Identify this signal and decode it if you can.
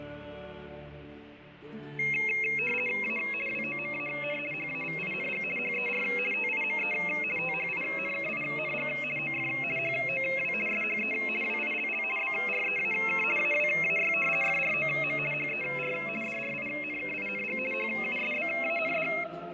RTTY (50 baud, 450 Hz shift), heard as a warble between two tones, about 2350 Hz centre, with fading. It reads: A WOMAN HAVING HER TIME THINKING OF HOW SHE WILL BREAK AWAY FROM HER DRINKING HUSBAND